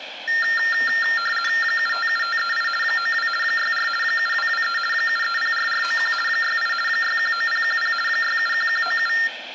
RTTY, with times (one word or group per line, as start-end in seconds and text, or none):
1.6-2.7 757538
2.8-3.3 92
3.4-3.9 64
4.0-4.8 7223
4.9-6.1 7304491
6.3-6.7 68
6.9-7.9 619010
8.1-9.1 671197